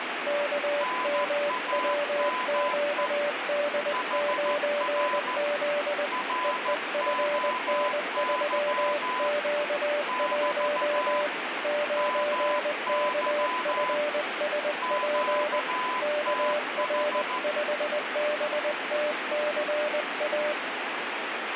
Morse code, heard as two keyed tones, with radio static. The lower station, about 20 wpm, 590 Hz: KMWQD9Z EEFN3Q1 9KFSP KR5BTCA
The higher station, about 14 wpm, 1010 Hz: NAME HR ROY <BT> MY QTH